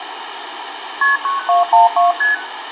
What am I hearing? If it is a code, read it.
Multi-frequency trunk signalling (R1, as on North American trunks), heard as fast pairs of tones, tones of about 150 ms, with phone line noise and room echo. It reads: KP 9212 ST